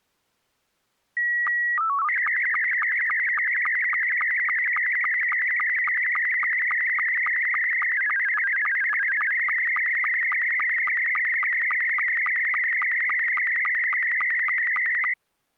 SSTV (slow-scan television), Scottie S2, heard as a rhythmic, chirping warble.